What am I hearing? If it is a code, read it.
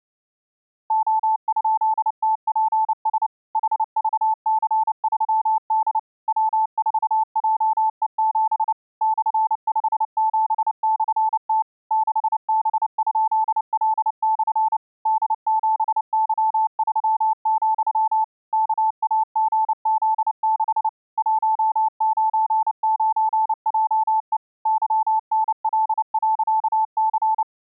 Morse code, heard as a keyed tone, machine-sent, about 29 wpm, 880 Hz. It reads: O?TPS HVC3D W4JE7 /57/T 6B?L/ D7Y3, KAGZ6 199JE YNL.C